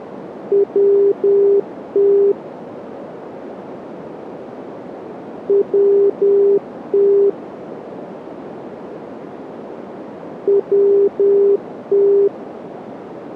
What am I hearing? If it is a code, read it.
Morse code, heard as a keyed tone, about 10 wpm, 400 Hz, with radio static and a narrow filter. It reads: WT WT WT